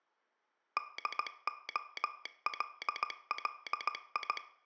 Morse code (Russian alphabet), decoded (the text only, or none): ДОЛЛИ